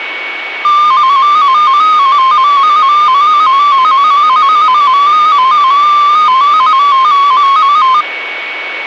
Multi-tone FSK (Olivia or MFSK type), about 250 Hz wide, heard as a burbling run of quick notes, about 15.625 baud, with a steady whistle near 2230 Hz.